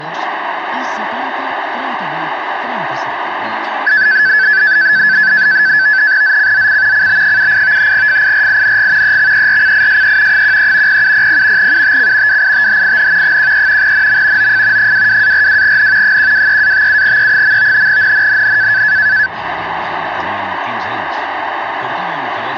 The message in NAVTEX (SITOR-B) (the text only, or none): ZCZC CB78 FIRING EXERCISE 13 0700 UTC WITHIN 13 NM OF 22-42N 123-57E. NNNN